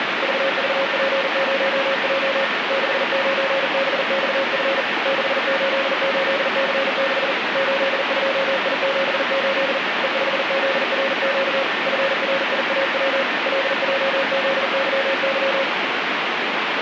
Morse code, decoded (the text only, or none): VVP0J 69BXF 688C6 82I78 E5ZRQ FRIAW LJZYY